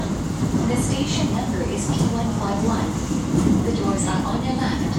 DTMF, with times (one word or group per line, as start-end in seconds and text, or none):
none